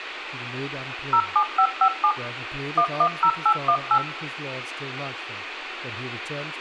DTMF, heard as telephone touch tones, dialled by machine, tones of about 80 ms, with radio hiss, room echo and speech in English. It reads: 07557 110818